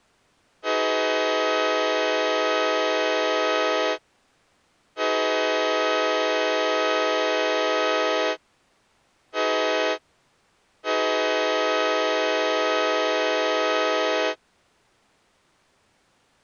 Train horn signal, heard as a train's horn. 2 long, 1 short, 1 long. On North American railways: approaching a public crossing.